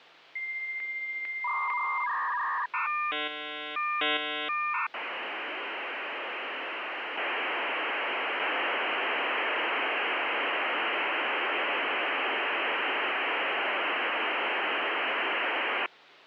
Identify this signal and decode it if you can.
Dial-up modem handshake (V.34 or later), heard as a whistle, warbles, then hiss, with hum.